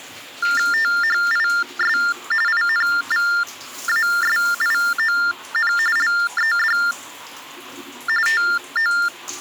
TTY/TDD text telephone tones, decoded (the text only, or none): THIS INVASION LED TO